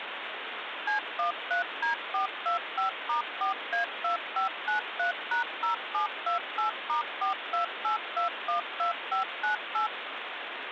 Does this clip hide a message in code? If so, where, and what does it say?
Yes: DTMF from 0.9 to 9.9 s, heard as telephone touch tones, dialled by machine, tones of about 120 ms, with phone line noise. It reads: C13D425*4A2593#0728*428212598